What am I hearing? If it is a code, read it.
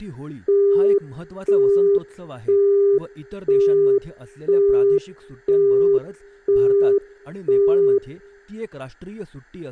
Telephone call progress tone (single-tone plan, as in Europe, Japan and elsewhere), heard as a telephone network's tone, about 400 Hz, 0.5 s on and 0.5 s off, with speech in Marathi. Busy tone.